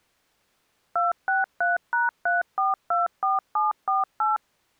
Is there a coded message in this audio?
Yes: DTMF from 1.0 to 4.4 s, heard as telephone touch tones, dialled by machine, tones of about 160 ms. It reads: 263#3424748